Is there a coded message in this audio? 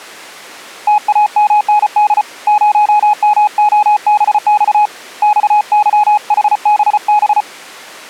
Yes: Morse code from 0.8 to 7.5 s, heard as a keyed tone, hand-sent with a paddle, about 34 wpm, 840 Hz. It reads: TAMND 0MOBX XYHBB